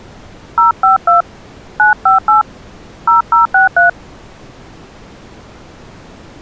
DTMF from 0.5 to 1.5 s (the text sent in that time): 052